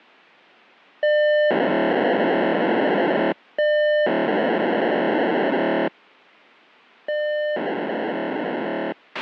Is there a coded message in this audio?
Yes: POCSAG pager data (1200 baud) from 1.0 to 8.9 s, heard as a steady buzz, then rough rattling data, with a squelch burst at the end.